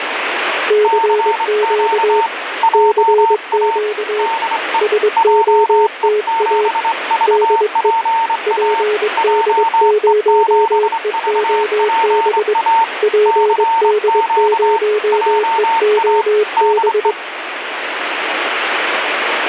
Morse code, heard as two keyed tones, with radio static. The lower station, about 22 wpm, 420 Hz: CQ CQ SOTA DE PD0EOB PD0EOB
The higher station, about 24 wpm, 910 Hz: CQ JA DE JE7VPA JE7VPA CQ JA DE